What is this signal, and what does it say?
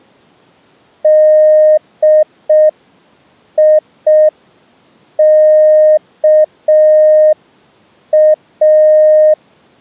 Morse code (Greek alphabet), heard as a keyed tone, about 5 wpm, 620 Hz. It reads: ΔΙΚΑ